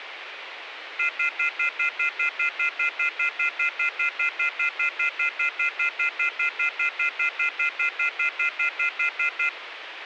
Telephone call progress tone (North American plan), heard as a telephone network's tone, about 1400, 2050, 2450, 2600 Hz, 0.1 s on and 0.1 s off, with phone line noise. Off-hook warning tone.